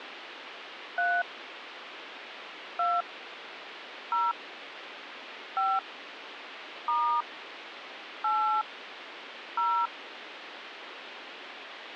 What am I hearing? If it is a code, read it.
DTMF, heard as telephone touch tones, dialled by hand, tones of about 300 ms, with phone line noise. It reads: 3 2 0 5 * 8 0